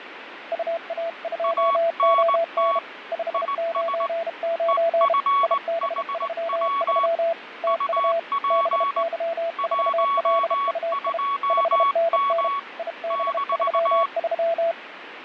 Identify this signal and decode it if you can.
Morse code, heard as two keyed tones, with radio static and fading. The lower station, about 32 wpm, 670 Hz: UA2ON 599 IB33 TU BY4LUI 5NN IB33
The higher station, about 19 wpm, 1120 Hz: ANT IS EFHW UP 12M -